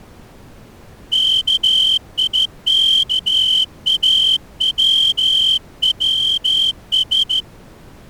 Morse code (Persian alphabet), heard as a whistle, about 14 wpm. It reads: کیکاووس